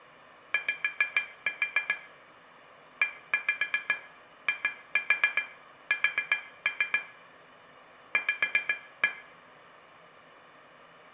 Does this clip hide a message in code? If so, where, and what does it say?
Yes: tap code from 0.5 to 9.2 s, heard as taps on glass, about 7 knocks a second, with room echo. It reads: Y EIS V